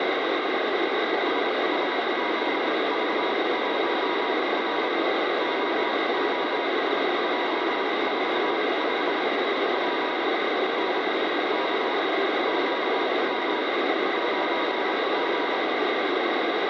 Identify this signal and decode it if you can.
Morse code, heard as a keyed tone, machine-sent, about 26 wpm, spaced as for 21 wpm, 960 Hz, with heavy radio static. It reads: SSZV1R OOIJ45 P N K QM 9G